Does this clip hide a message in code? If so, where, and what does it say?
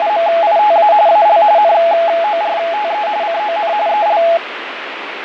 Yes: RTTY (45.45 baud, 170 Hz shift) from 0.0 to 4.4 s, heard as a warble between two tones, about 760 Hz centre, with radio static and fading. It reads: … AL NORTE CON EL